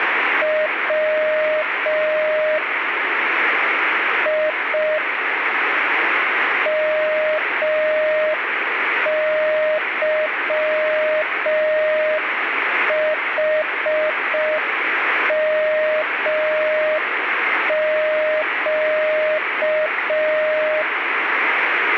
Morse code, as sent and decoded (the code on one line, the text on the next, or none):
.-- / .. / -- -.-- .... -- --.-
W I MYHMQ